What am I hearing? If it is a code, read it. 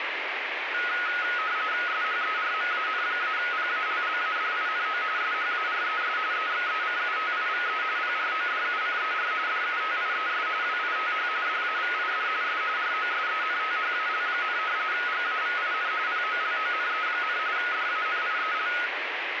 RTTY (45.45 baud, 170 Hz shift), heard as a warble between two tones, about 1360 Hz centre, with radio static. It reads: SHERMAN-PALLADINO SHARES EXECUTIVE PRODUCER DUTIES WITH DAVID S ROSENTHAL, GAVIN POLONE, DANIEL